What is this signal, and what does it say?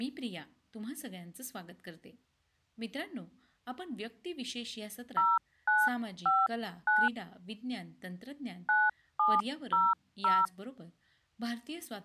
DTMF, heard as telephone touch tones, dialled by hand, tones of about 210 ms, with speech in Gujarati. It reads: 0959 9700